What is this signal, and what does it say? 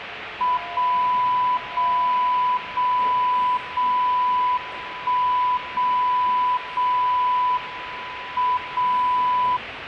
Radio time signal (WWVB), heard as a tone whose level steps once a second, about 1000 Hz, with radio static and the noise of a subway station. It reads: 0 0 0 0 1 0 0 M 0